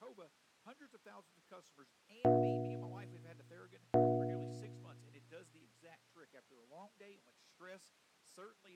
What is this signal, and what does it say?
Clock strike, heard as a bell, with speech in English. 2. Two o'clock.